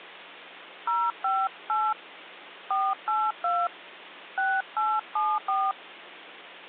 DTMF, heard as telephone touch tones, dialled by hand, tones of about 230 ms, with hum. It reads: 058 482 6874